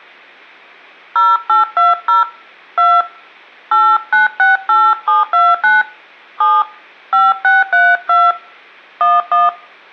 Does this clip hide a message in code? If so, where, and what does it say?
Yes: DTMF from 1.2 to 9.5 s, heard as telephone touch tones, dialled by hand, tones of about 200 ms. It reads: 0820 2 8968729 7 5632 11